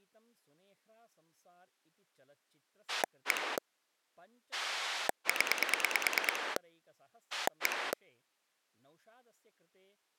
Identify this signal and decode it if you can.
Pulse dialling, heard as a rotary dial, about 9 pulses a second, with speech in Sanskrit. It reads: 1 0 1